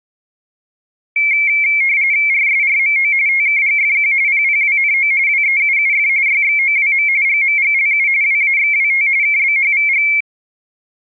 RTTY (45.45 baud, 170 Hz shift), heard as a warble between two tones, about 2250 Hz centre. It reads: RSRMO TKGFQ PPWNO WEUUF YXOWM GMGLU WAXWT KBHVG